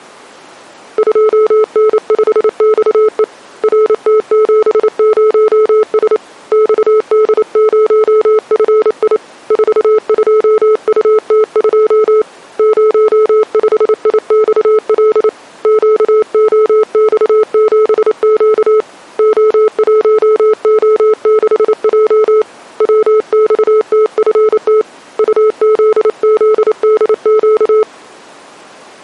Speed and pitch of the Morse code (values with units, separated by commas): 28 wpm, 430 Hz